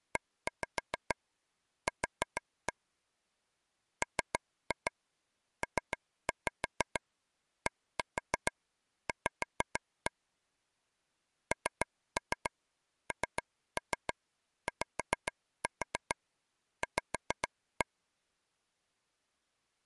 Tap code, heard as taps on a table, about 6 knocks a second. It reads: EQ MPDV NNYV